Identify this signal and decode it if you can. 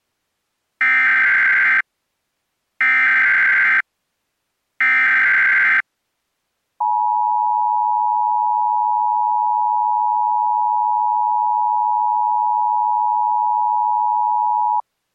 Emergency Alert System (SAME) tones (header bursts, then the 853 and 960 Hz attention tone), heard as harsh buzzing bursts, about 520.83 baud.